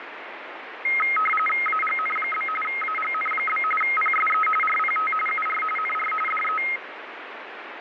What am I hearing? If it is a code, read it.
RTTY (45.45 baud, 850 Hz shift), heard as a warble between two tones, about 1700 Hz centre, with radio static. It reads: AGN? AGN? PSE RPT UR NR DE